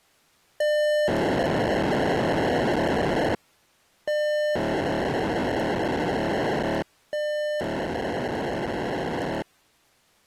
POCSAG pager data (1200 baud), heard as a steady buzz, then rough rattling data.